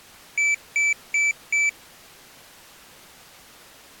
Beep code, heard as a piezo beeper, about 2300 Hz. 4 short. In AMI BIOS tables: system timer failure; in Dell tables: memory read or write failure.